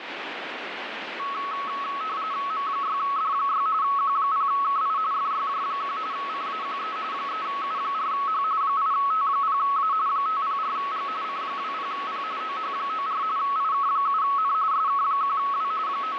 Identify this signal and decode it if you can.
RTTY (45.45 baud, 170 Hz shift), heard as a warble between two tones, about 1200 Hz centre, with radio static. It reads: M6D6 Q0KI FYJ1 CAQE 3U4H 8T0A 504G C20P OH94 IK7N SK1W …